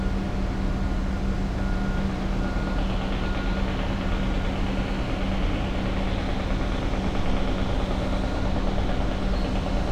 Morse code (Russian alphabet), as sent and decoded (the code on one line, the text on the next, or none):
none